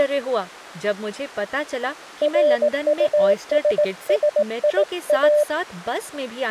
Morse code, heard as a keyed tone, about 18 wpm, 600 Hz, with speech in Hindi. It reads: RUSSIA